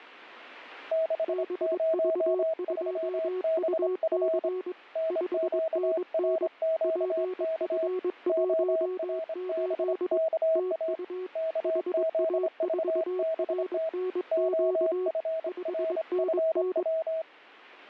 Morse code, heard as two keyed tones. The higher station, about 25 wpm, 650 Hz: 603BF NQRQK ORBKA KZVBT OFRFW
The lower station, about 22 wpm, 370 Hz: BV2UC 5NN PF18 TU HA4RNQ 5NN